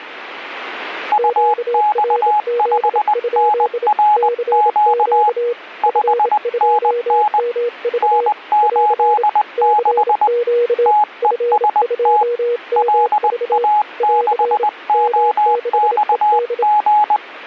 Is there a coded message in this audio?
Yes: Morse code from 1.1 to 17.2 s, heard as two keyed tones. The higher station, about 20 wpm, 840 Hz: UX5NRQ 5NN N86 TEST LA6OXG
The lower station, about 27 wpm, 480 Hz: QRZ? CQ F2MV <AR> CQ F2MV <AR> M6ED